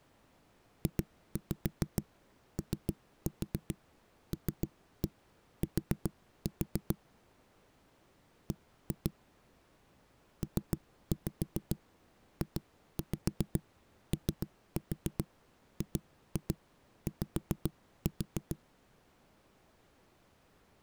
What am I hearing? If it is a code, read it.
Tap code, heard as knocks on a wall, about 7 knocks a second. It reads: JOLT B PJOGY